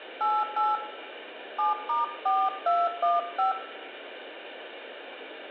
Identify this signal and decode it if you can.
DTMF, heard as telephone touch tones, dialled by hand, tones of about 180 ms, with room echo. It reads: 88 7*4215